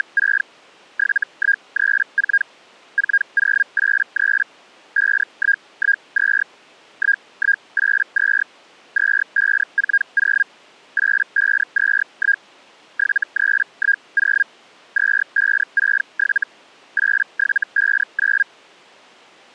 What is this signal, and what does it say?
Hellschreiber (Feld-Hell, 122.5 baud), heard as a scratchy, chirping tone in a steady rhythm, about 1600 Hz. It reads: … 7134 4083 5112 1182 2540 8521 7310 2567 8759